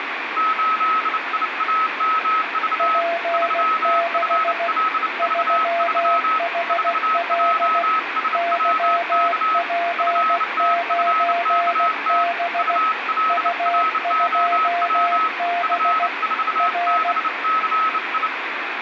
Morse code, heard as two keyed tones, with radio static. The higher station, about 29 wpm, 1290 Hz: 8IAMV 3FLV3 4JSWK FTFKT ULROW F4BCI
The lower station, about 16 wpm, 690 Hz: P6 3HL YP9B U2B R